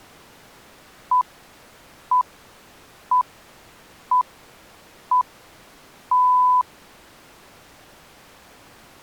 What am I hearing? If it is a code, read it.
Radio time signal (six pips, as the Greenwich Time Signal), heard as pips.